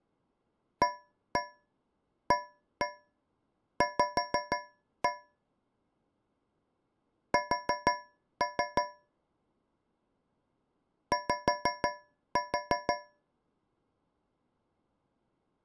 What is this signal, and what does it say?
Tap code, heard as taps on a metal pipe, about 6 knocks a second. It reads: AAV S Y